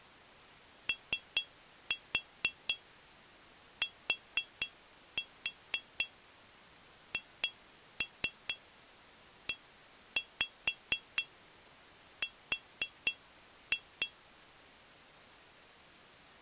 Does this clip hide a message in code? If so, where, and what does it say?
Yes: tap code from 0.9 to 14.2 s, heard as taps on glass, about 4 knocks a second. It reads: OTHER